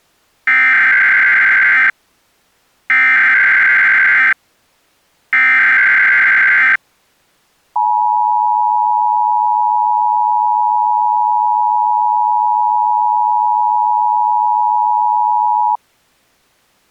Emergency Alert System (SAME) tones (header bursts, then the 853 and 960 Hz attention tone), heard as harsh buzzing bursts, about 520.83 baud.